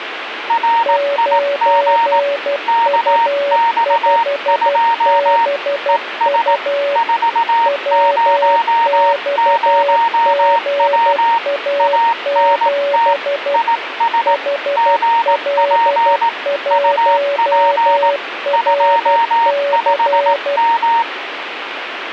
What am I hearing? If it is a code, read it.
Morse code, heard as two keyed tones, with radio static. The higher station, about 18 wpm, 930 Hz: RIG KX2 ES 400W ANT IS GP UP 25M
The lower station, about 12 wpm, 570 Hz: 9U5BU WXGA7 HL1RC